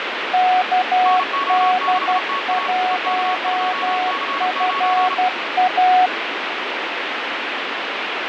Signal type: Morse code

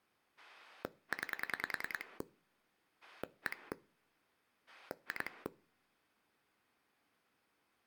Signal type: pulse dialling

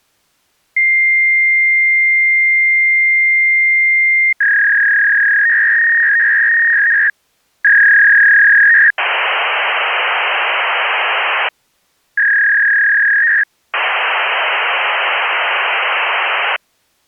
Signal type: fax machine handshake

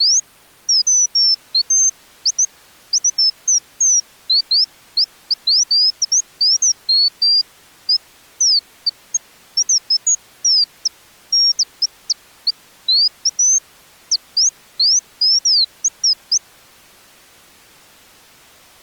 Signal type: none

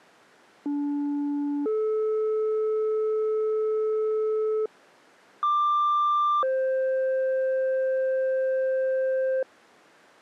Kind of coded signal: two-tone page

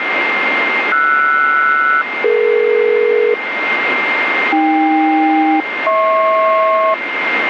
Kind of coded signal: aircraft SELCAL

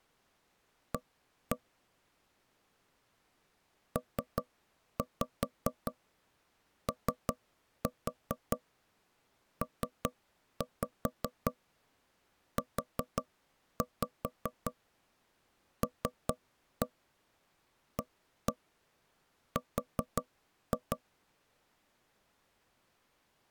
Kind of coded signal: tap code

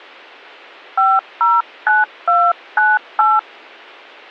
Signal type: DTMF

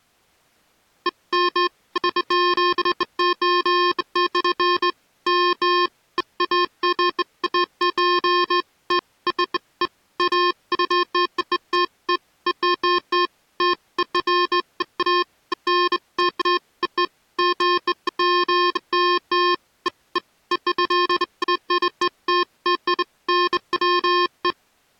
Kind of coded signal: none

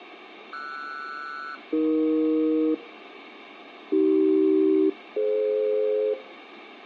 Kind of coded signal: aircraft SELCAL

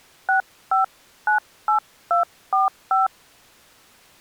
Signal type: DTMF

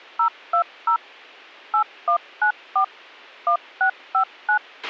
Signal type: DTMF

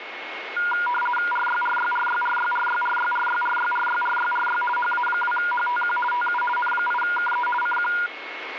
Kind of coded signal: RTTY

